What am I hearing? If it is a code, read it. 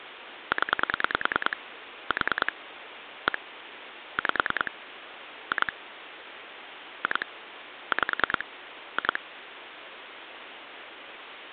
Pulse dialling, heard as clicks on a phone line, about 10 pulses a second, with phone line noise. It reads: 0 4 1 5 2 2 5 2